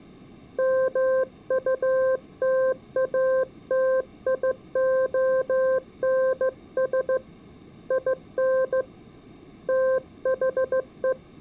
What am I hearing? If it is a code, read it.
Morse code, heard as a keyed tone, hand-sent with a straight key, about 15 wpm, 520 Hz. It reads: MUTATIONS IN THE